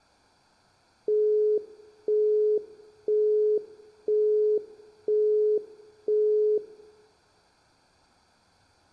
Telephone call progress tone (single-tone plan, as in Europe, Japan and elsewhere), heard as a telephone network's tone, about 420 Hz, 0.5 s on and 0.5 s off, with room echo. Busy tone.